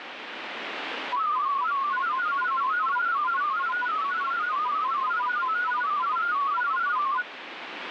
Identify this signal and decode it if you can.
Multi-tone FSK (Olivia or MFSK type), about 500 Hz wide, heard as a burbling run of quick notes, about 31.25 baud, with radio static.